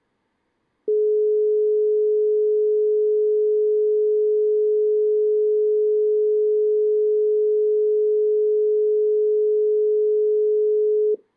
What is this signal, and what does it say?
Telephone call progress tone (425 Hz plan, as in most of Europe), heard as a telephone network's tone, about 420 Hz. Dial tone.